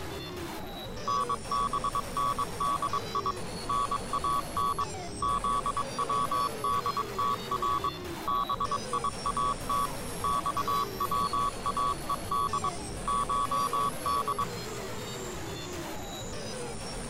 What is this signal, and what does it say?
Morse code (Persian alphabet), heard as a keyed tone, machine-sent, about 22 wpm, 1130 Hz. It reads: نبندی نان زودتر بیات خواهد شد